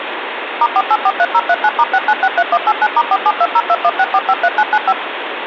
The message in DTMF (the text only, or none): *4843039*6963189*4720216453995